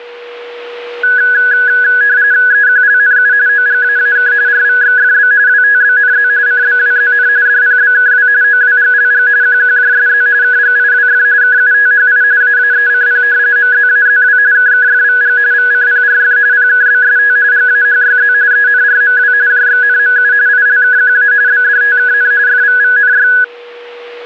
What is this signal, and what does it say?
RTTY (45.45 baud, 170 Hz shift), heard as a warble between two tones, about 1600 Hz centre, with a steady whistle near 480 Hz. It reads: EQLNU OGAAK RVXFB WTBNZ CBWZN DPBKW OWGLG QQJSZ KGIWF KUTHI AAECP MZAZW KKFVG VCPRF PKBST GAHYZ ENRMW JXNMU ILKQA BDTKN FVVNY